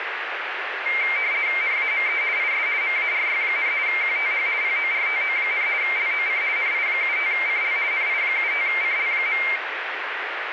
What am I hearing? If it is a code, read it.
RTTY (50 baud, 170 Hz shift), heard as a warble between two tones, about 2200 Hz centre, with radio static. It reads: NAME IS MARY, QTH PORTO, LOC NI75CL NI75CL.